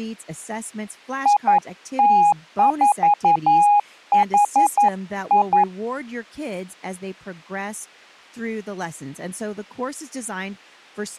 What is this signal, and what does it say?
Morse code, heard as a keyed tone, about 11 wpm, 820 Hz, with speech in English. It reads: IT4HI